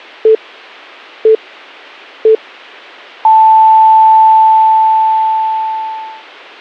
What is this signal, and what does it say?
Radio time signal (three low pips and a long one an octave up, as on NHK), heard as pips.